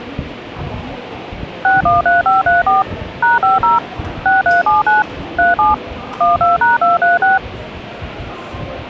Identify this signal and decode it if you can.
DTMF, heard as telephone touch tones, dialled by machine, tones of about 160 ms, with the noise of a crowd indoors. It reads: 613534 #50 6379 37 12#236